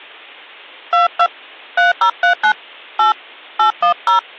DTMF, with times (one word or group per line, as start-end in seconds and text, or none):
0.9-1.3 22
1.8-2.5 3039
3.0-3.1 8
3.6-4.2 810